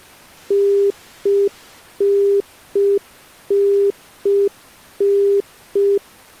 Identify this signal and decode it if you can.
Telephone call progress tone (UK plan), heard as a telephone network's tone, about 400 Hz. Congestion tone.